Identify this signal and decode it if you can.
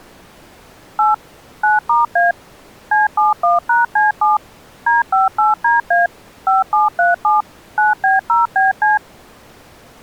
DTMF, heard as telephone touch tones, dialled by machine, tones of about 160 ms. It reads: 8 9*A C71#C7 D58DA 5737 9B0BC